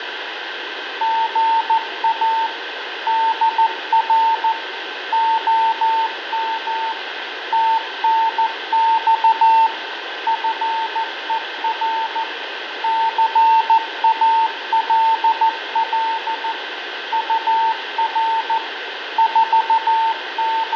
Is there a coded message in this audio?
Yes: Morse code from 1.0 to 20.8 s, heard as a keyed tone, machine-sent, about 14 wpm, 900 Hz, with radio static, fading and room echo. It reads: GA DR OM TNX FER CALL UR …